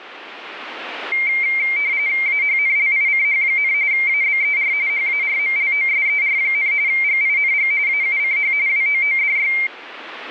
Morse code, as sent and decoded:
none

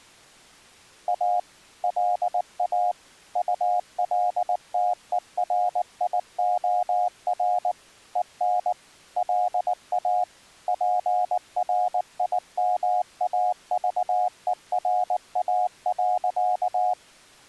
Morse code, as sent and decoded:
.- / .-.. .- / ..- .-.. - . .-. .. --- .-. / . -. / .-.. .- / .--. .-. .. -- .- ...- . .-. .- .-.-.-
A LA ULTERIOR EN LA PRIMAVERA.

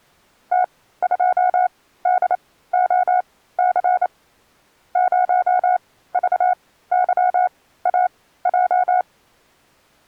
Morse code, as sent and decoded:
- ..--- -.. --- -.-. / ----- ...- -.-- .- .---
T2DOC 0VYAJ

